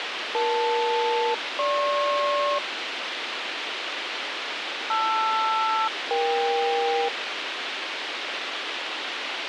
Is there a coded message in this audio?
Yes: aircraft SELCAL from 0.3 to 7.1 s, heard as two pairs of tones, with radio hiss. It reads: EL-GP LR-EK